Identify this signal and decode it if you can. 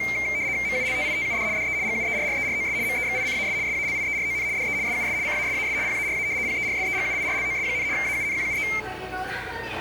RTTY (75 baud, 170 Hz shift), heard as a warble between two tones, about 2200 Hz centre, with the noise of a subway station. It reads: MULTITUD DE GUERREROS MEXICAS SALIERON DE SUS CASAS PARA PERSEGUIRLOS, AUNQUE